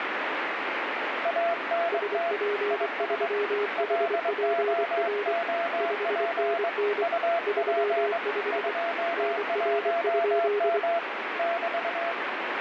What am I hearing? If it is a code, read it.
Morse code, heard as two keyed tones, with heavy radio static. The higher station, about 22 wpm, 680 Hz: ANT IS LOOP UP 21M <BT>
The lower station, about 24 wpm, 410 Hz: SP3HPR 5NN 35 NR?